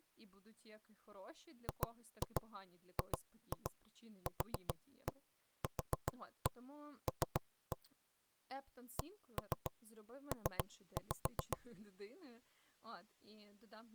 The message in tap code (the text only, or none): GGQQL CP